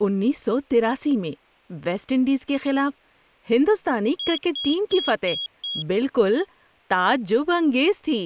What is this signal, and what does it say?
Beep code, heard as a piezo beeper, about 3300 Hz, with speech in Urdu. 5 short. In AMI BIOS tables: processor failure; in Dell tables: CMOS battery failure.